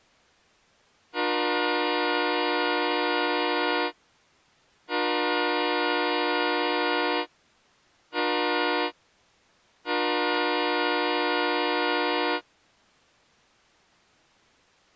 Train horn signal, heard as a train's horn. 2 long, 1 short, 1 long. On North American railways: approaching a public crossing.